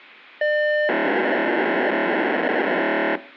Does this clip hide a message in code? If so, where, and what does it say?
Yes: POCSAG pager data (1200 baud) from 0.4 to 3.2 s, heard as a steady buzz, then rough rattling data.